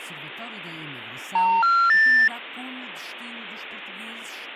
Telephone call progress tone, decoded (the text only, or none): special information tone